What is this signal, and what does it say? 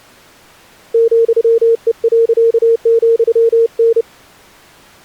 Morse code, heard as a keyed tone, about 30 wpm, 460 Hz. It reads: ,E.,N